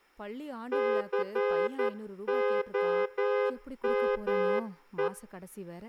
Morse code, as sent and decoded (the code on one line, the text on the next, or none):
-.-. --- -- .
COME